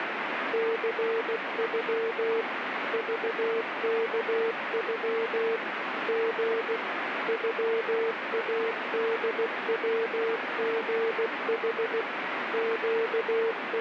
Morse code (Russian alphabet), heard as a keyed tone, machine-sent, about 16 wpm, 450 Hz, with heavy radio static. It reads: ЦЮ ЖКЮ Г ЮАДВГХ …